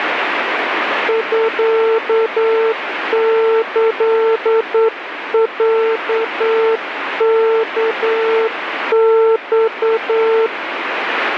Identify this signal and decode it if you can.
Morse code (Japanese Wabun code), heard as a keyed tone, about 9 wpm, 450 Hz, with radio static. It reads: ミキロワマ